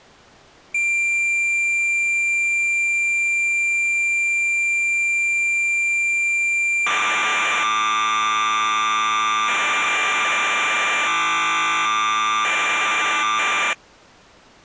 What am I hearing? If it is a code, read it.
Cassette data (Kansas City type), 1200 baud, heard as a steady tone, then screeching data.